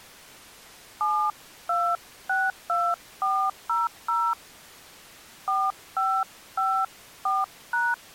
DTMF, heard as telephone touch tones, dialled by hand, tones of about 240 ms. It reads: 7262400 4554#